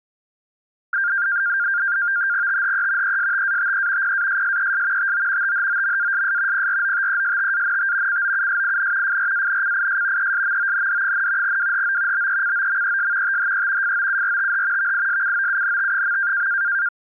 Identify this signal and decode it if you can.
NAVTEX (SITOR-B), 100 baud, 170 Hz shift, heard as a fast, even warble, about 1500 Hz centre. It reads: THE ESTATE PASSES TO THOMASS PROTESTANT COUSIN FRANCIS ESMOND, WHO BECOMES THE FOURTH VISCOUNT.